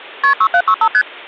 Multi-frequency trunk signalling (R1, as on North American trunks), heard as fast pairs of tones, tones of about 70 ms. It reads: KP 6765 ST